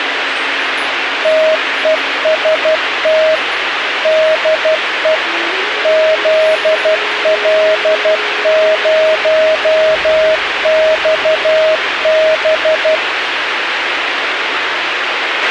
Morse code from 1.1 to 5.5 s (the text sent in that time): TEST DE